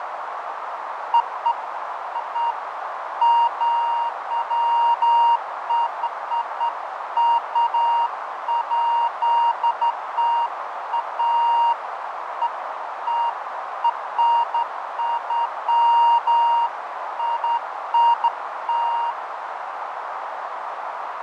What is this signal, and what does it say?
Beeps of irregular length, with radio static, fading and a narrow filter. There is no code.